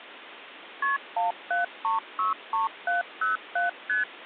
Multi-frequency trunk signalling (R1, as on North American trunks), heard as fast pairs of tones, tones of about 140 ms, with phone line noise. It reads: KP 17363707 ST